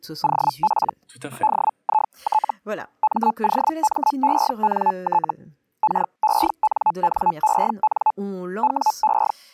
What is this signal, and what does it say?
Hellschreiber (Feld-Hell, 122.5 baud), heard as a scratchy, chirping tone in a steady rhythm, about 860 Hz, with speech in French. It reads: OP DIT MOMENT KENNEN WE